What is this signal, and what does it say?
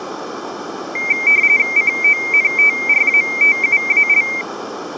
RTTY (45.45 baud, 170 Hz shift), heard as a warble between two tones, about 2200 Hz centre. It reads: CONTRATUAL